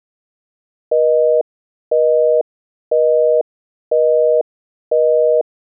Telephone call progress tone (North American plan), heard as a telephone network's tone, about 480, 620 Hz, 0.5 s on and 0.5 s off. Busy tone.